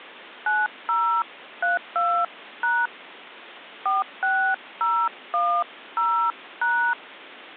DTMF, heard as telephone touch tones, dialled by hand, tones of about 240 ms. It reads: 9032# 46010#